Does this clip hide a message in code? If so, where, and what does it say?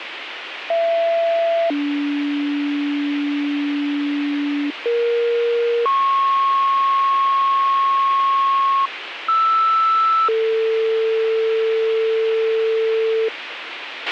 Yes: two-tone page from 0.7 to 13.3 s, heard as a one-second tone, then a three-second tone, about 670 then 290 Hz, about 470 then 1090 Hz, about 1320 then 450 Hz, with radio hiss and a squelch burst at the end.